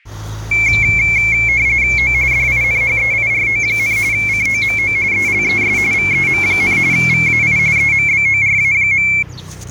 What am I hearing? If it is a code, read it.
RTTY (45.45 baud, 170 Hz shift), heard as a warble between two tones, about 2250 Hz centre, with the noise of a residential street. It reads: O DINHEIRO, COMO ELES VEM, VAI EMBORA.